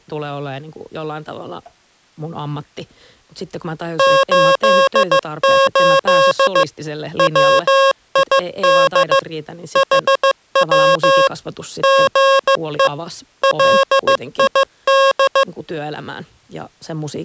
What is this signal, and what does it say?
Morse code, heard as electronic beeps, machine-sent, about 15 wpm, 540 Hz, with speech in Finnish. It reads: 88 WID HW GE LID